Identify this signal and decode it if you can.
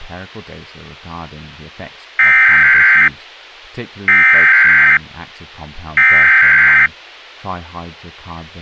Emergency Alert System (SAME) tones (header bursts), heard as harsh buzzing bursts, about 520.83 baud, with speech in English.